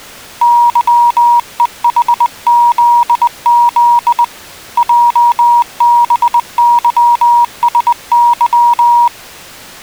Morse code, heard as a keyed tone, hand-sent with a bug key, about 20 wpm, 950 Hz. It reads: YEHZZ JBYSY